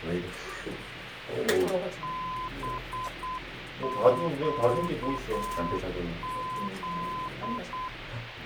Morse code, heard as a keyed tone, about 8 wpm, 1020 Hz, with radio hiss and the noise inside a lift. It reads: BQZ